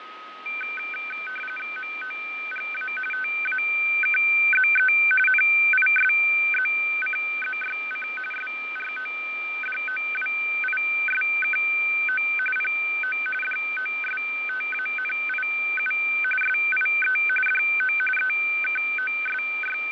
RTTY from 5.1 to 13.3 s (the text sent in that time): NISZCZYC SRODOWISKO PO